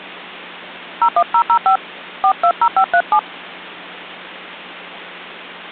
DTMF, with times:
1.0-1.8 01005
2.2-3.2 420537

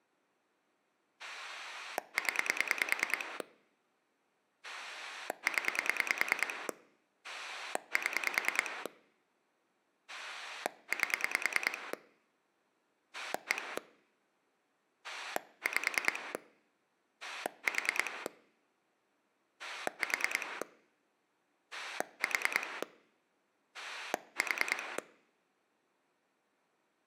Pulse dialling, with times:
1.2-3.4 0
4.6-6.7 0
7.2-8.9 7
10.1-11.9 8
13.1-13.8 1
15.0-16.3 5
17.2-18.3 4
19.6-20.6 4
21.7-22.8 4
23.7-25.0 4

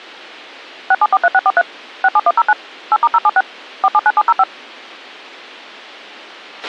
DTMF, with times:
0.9-1.6 6743643
2.0-2.5 67109
2.9-3.4 8*076
3.8-4.4 479705

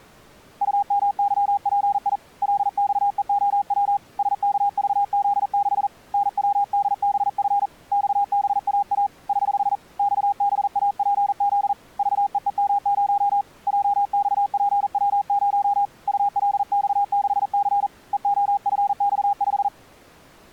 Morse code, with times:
0.6-2.2 UMYPI
2.4-4.0 LXEOW
4.2-5.9 SKVZ6
6.1-7.7 NWDBF
7.9-9.1 XBAA
9.3-9.8 <HH>
10.0-11.7 XBAPZ
12.0-13.4 VEEM0
13.7-15.8 JXPW0
16.1-17.9 ULX6C
18.1-19.7 EOFX5

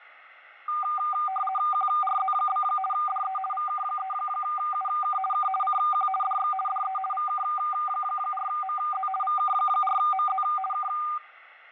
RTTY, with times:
1.7-2.6 QRZ?
2.9-3.4 DE
3.5-5.2 VK3UK
5.3-5.5 K
5.6-6.1 CQ
6.2-6.5 DX
6.7-7.0 DE
7.1-9.1 VK4MZ
9.2-10.4 VK4MZ
10.7-10.9 K

